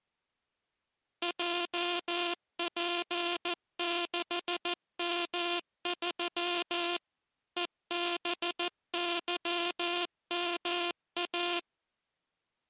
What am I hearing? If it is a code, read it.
Morse code, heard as a buzzer, machine-sent, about 14 wpm. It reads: JP6M3 EBYMA